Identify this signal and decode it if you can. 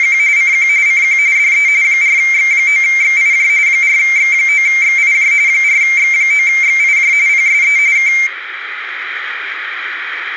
RTTY (45.45 baud, 170 Hz shift), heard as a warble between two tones, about 2200 Hz centre, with radio static and room echo. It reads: … CQ CQ DE 4X9XIJ 4X9XIJ 4X9XIJ PSE K